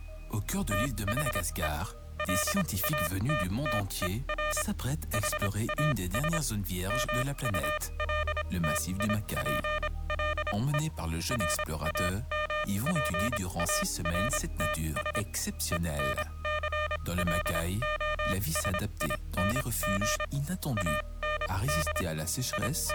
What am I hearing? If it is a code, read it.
Morse code, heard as electronic beeps, machine-sent, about 26 wpm, spaced as for 21 wpm, 610 Hz. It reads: THE LATTER HAS MULTIPLE RAMPARTS ENCLOSING AND …